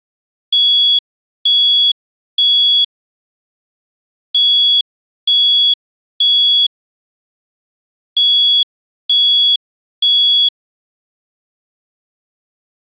Alarm pattern, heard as an alarm's beeps, played three times, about 3350 Hz. Temporal three. Smoke or fire, evacuate.